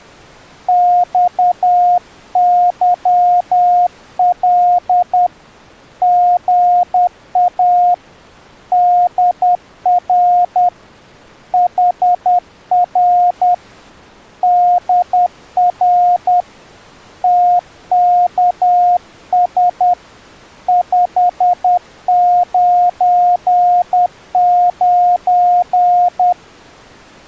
Morse code, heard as a keyed tone, hand-sent with a paddle, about 10 wpm, 710 Hz. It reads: XYL GA DR HR DR TKS 599